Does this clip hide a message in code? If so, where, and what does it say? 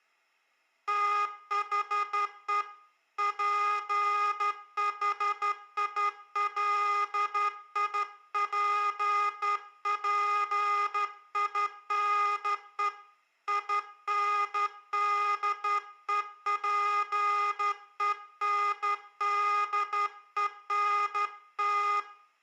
Yes: Morse code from 0.8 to 22.1 s, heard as a buzzer, hand-sent with a straight key, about 12 wpm, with room echo. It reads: THE PHILIPPINE INDEPENDENT